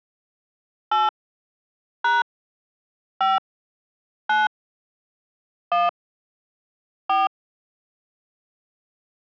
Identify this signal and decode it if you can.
DTMF, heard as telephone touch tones, dialled by hand, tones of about 180 ms. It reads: 8 # 5 9 1 4